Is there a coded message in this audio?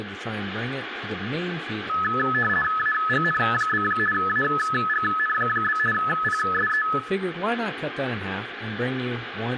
Yes: RTTY (50 baud, 450 Hz shift) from 1.9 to 7.0 s, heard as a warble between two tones, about 1500 Hz centre, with radio static, room echo and speech in English. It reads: AGN? AGN? PSE